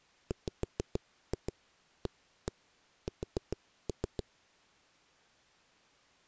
Tap code, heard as knocks on a wall, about 6 knocks a second. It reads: WAS